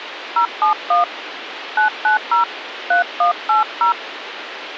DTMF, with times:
0.4-1.0 071
1.8-2.4 990
2.9-3.9 3180

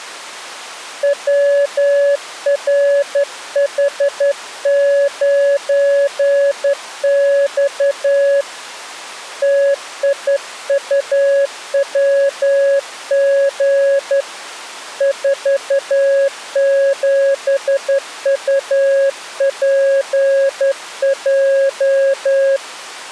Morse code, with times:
1.0-8.4 WRH9X
9.4-14.2 TIUWG
15.0-22.6 47UPJ

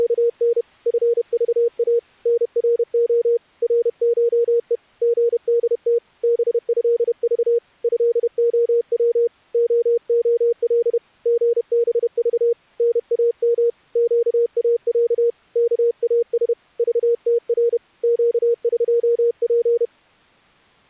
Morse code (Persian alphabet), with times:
0.0-0.6 …
0.9-2.0 فذا
2.3-3.4 نرع
3.6-4.8 رشه
5.0-6.0 ژدت
6.2-7.6 بضذ
7.8-9.3 ضعو
9.5-11.0 ععل
11.3-12.5 ژبذ
12.8-13.7 نام
14.0-15.3 گاص
15.6-16.5 کاس
16.8-17.8 ذتر
18.0-19.8 گقپ

